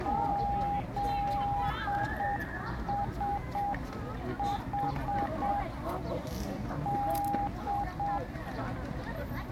Morse code (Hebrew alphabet), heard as a keyed tone, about 7 wpm, 810 Hz, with the noise of a park. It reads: זשח ד